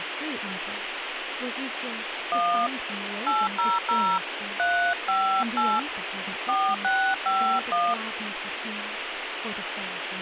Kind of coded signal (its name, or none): DTMF